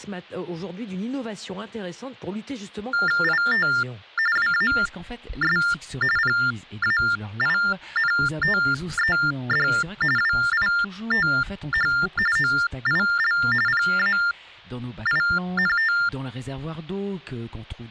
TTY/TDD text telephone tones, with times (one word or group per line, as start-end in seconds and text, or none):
3.2-3.7 IT
4.4-5.6 WAS
6.2-9.7 PAINTED
10.2-11.9 WITH
12.4-13.4 OIL
13.7-15.9 PAINT